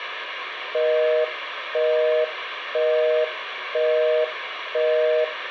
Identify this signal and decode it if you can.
Telephone call progress tone (North American plan), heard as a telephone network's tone, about 480, 620 Hz, 0.5 s on and 0.5 s off, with phone line noise. Busy tone.